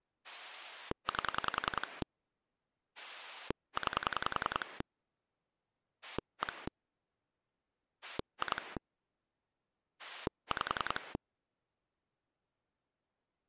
Pulse dialling, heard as a rotary dial, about 10 pulses a second. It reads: 8 9 1 2 5